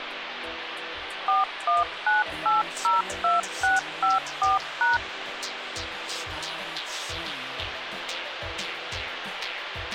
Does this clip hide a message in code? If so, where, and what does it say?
Yes: DTMF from 1.3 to 5.0 s, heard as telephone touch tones, dialled by machine, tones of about 160 ms, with phone line noise. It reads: 419802654#